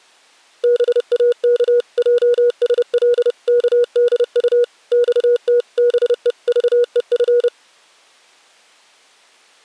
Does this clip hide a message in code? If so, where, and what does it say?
Yes: Morse code (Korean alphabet) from 0.6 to 7.5 s, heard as a keyed tone, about 30 wpm, 480 Hz. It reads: 동혁의 커다란